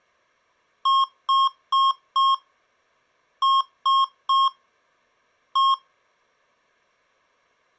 Beep code, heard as beeps from a small speaker, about 1080 Hz. 4-3-1. In Phoenix BIOS tables: memory failure above the first 64 KB.